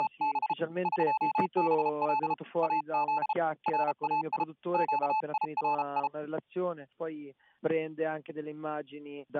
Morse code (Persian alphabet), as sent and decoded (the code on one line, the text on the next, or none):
… / ...--- -... .-.. / .- --.. / .-. .- .. / --.- .. .-. ..
… قبل از رای گیری